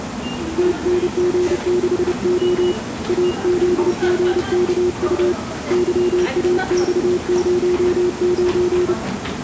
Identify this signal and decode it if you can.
Morse code, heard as a keyed tone, hand-sent with a paddle, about 30 wpm, 360 Hz, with the noise of a subway station. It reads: TNG6O AZGKU YAX09